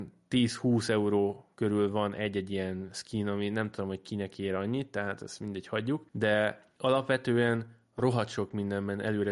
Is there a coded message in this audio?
No, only speech in Hungarian.